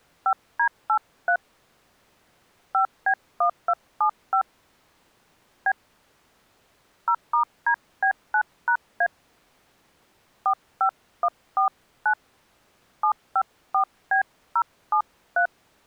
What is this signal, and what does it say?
DTMF, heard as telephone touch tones, dialled by hand, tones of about 80 ms. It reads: 5D83 5B1275 B 0*DB9#A 45149 754B073